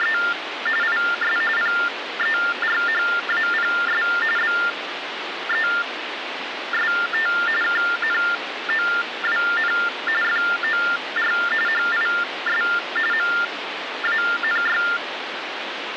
TTY/TDD text telephone tones (45.45 baud Baudot), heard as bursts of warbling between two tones, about 400 Hz shift, 1600 Hz centre, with phone line noise. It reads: … IS PERHAPS BEST KNOWN FOR HIS MANY